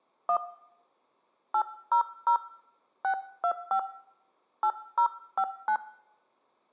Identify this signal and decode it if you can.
DTMF, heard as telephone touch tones, dialled by hand, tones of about 80 ms, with room echo. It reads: 1 800 625 8059